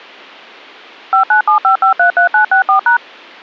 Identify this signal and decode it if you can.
DTMF, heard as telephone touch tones, dialled by machine, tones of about 110 ms. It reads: 5975533964#